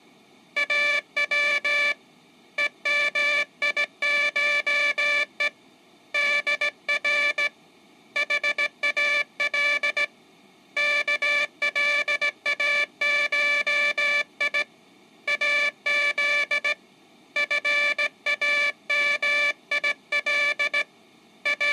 Morse code (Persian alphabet), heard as a buzzer, hand-sent with a straight key, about 17 wpm. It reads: او همیشه در حال کلاشی از فامیل …